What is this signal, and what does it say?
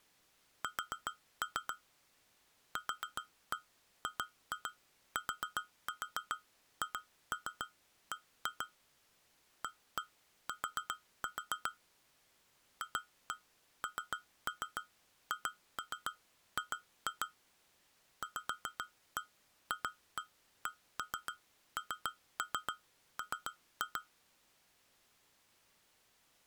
Tap code, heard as taps on glass, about 7 knocks a second. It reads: S QGTHB AT FNHG VFCNM